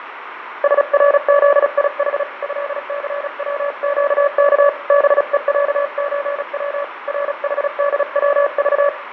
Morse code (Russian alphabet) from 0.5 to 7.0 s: СРЗИХ ЭЦВЩК БЕЯЧВ

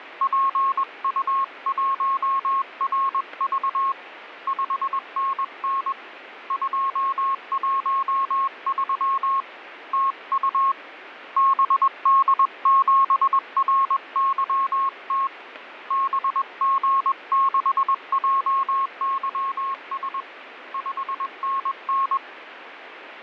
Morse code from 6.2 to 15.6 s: 213 TU BD7RYT

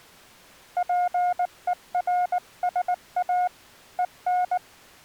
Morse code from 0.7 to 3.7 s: PERSA

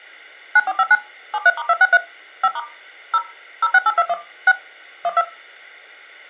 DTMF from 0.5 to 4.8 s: 9459 73*263 5* 0 06821 6

